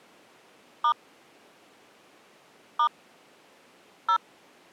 DTMF, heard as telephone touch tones, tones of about 80 ms. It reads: * * 0